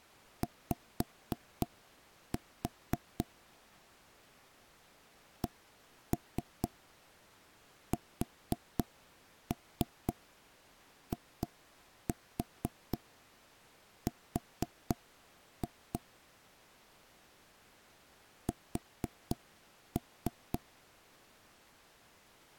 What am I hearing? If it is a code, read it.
Tap code, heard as knocks on wood, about 4 knocks a second. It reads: Y CSIR S